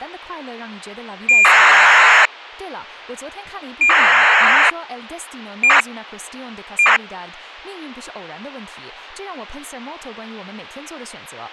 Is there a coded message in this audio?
Yes: ACARS aircraft data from 1.3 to 7.0 s, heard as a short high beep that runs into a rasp, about 2400 baud, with a squelch burst at the end.